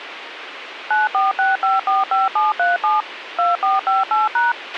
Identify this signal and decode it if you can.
DTMF, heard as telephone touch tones, dialled by machine, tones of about 170 ms, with radio hiss and a squelch burst at the end. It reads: 946545737 2458#